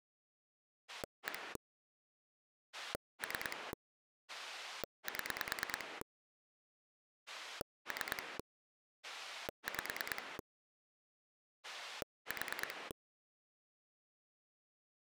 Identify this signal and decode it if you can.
Pulse dialling, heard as a rotary dial, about 9 pulses a second. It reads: 1 3 7 3 5 4